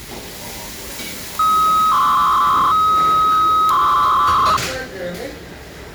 300-baud modem data (Bell 103 tones), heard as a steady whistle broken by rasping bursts, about 300 baud, 200 Hz shift, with the noise of a restaurant.